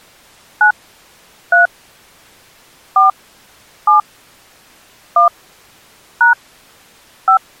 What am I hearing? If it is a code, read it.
DTMF, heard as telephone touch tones, dialled by hand, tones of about 120 ms. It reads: 9 3 4 7 1 # 5